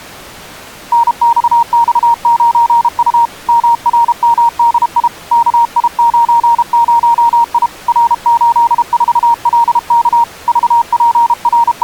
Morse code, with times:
0.9-3.3 NXX9U
3.5-5.1 MRMDI
5.3-7.7 KI90I
7.9-10.2 R84LK
10.5-11.8 …

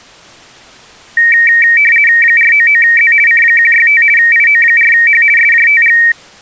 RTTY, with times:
2.2-3.1 499Z
3.3-4.0 C165
4.2-5.2 IO4H
5.4-6.0 SJTG

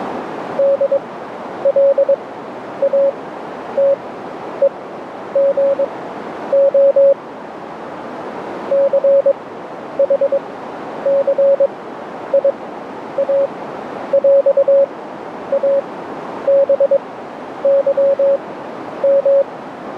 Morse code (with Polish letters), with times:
0.6-7.1 DLATEGO
8.7-19.4 CHCIAŁABYM

